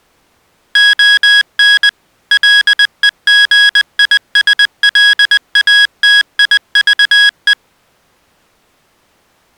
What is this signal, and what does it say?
Morse code, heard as electronic beeps, machine-sent, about 20 wpm, 1650 Hz. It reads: ON LEGISLATIVE